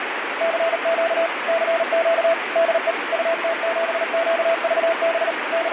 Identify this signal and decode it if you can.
Morse code, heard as a keyed tone, machine-sent, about 38 wpm, 660 Hz, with radio static. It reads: CQ CQ DE UT7QVB …